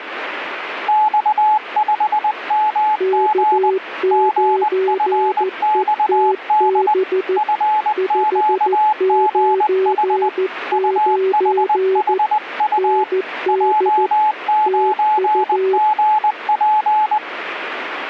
Morse code, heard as two keyed tones, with radio static. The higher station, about 20 wpm, 860 Hz: X5MG GFXD FQGH UHHU J9GP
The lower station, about 14 wpm, 380 Hz: K9ETB 599 ND TU